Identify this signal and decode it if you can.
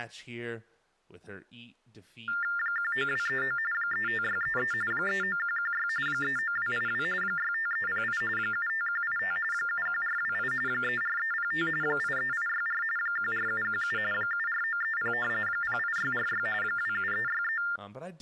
TTY/TDD text telephone tones (45.45 baud Baudot), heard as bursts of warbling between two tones, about 400 Hz shift, 1600 Hz centre, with speech in English. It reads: 19239 35633 39116 39282 65308 75185 71428 34305 83864 14717 74930 08646 27363